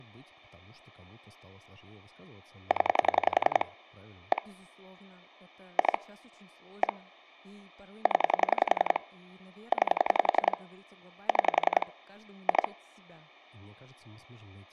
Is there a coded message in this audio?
Yes: pulse dialling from 2.7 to 12.7 s, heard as clicks on a phone line, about 11 pulses a second, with speech in Russian. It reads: 0 1 2 1 0 9 6 2